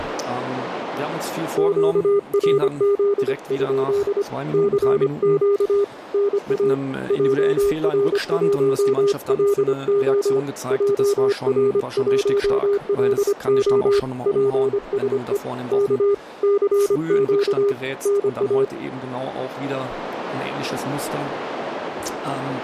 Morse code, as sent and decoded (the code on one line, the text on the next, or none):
--.- .-. --.. ..--.. / -.-. --.- / -. .- / .--- .-. .---- .-.. --- / .--- .-. .---- .-.. --- / .--. ... . / -.- / -.-. --.- / -. .-
QRZ? CQ NA JR1LO JR1LO PSE K CQ NA